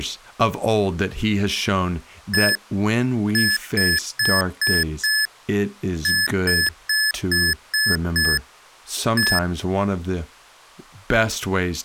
Beep code, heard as beeps from a small speaker, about 1700 Hz, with speech in English. 1-5-6-1.